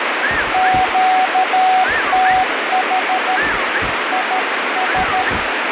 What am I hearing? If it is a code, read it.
Morse code, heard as a keyed tone, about 13 wpm, 750 Hz, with heavy radio static. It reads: QTH IS